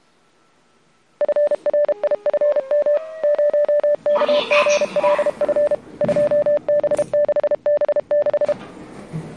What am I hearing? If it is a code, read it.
Morse code, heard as a keyed tone, machine-sent, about 32 wpm, 590 Hz, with the noise inside a lift. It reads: FRIFM 0KGLF 2B6B6